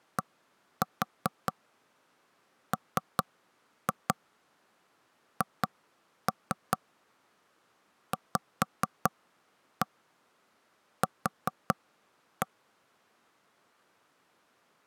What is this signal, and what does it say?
Tap code, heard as knocks on wood, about 4 knocks a second. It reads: DMHVQ